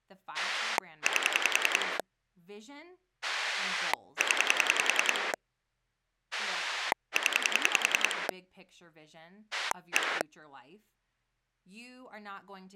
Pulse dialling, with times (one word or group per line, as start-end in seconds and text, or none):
0.3-2.0 8
3.2-5.3 0
6.3-8.3 0
9.5-10.2 1